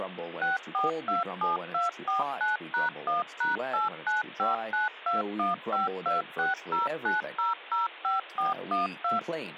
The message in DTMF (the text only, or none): 6427249#1#89592152609005412